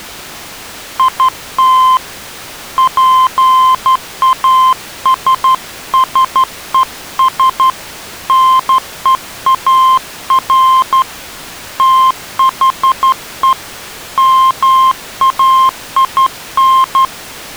Morse code, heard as a keyed tone, hand-sent with a straight key, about 12 wpm, 1040 Hz. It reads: IT PASSES NEAR THE MAIN